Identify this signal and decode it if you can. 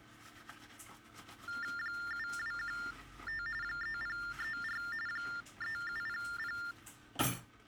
TTY/TDD text telephone tones (45.45 baud Baudot), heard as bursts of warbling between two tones, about 400 Hz shift, 1600 Hz centre, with kitchen noise. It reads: 7215 3034 3700